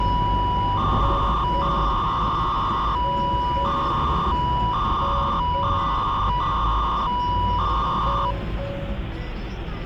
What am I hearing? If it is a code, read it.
300-baud modem data (V.21 tones), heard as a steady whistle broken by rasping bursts, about 300 baud, 200 Hz shift, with the noise inside a car.